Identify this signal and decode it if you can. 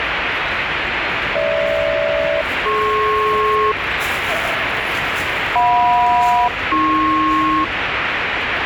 Aircraft SELCAL, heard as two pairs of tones, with radio static and the noise of a subway station. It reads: GH-DP JM-AP